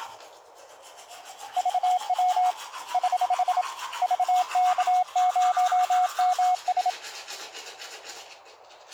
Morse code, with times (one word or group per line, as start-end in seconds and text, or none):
1.6-2.5 VW
2.9-3.6 <HH>
4.0-6.9 VK0MS